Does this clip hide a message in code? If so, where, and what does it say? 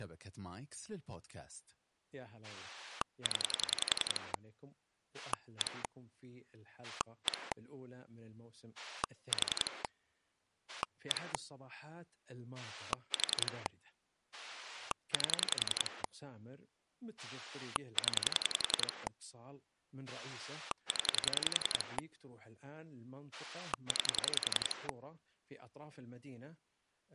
Yes: pulse dialling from 2.4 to 24.9 s, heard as a rotary dial, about 11 pulses a second, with speech in Arabic. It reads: 0 1 1 4 1 4 8 0 0 9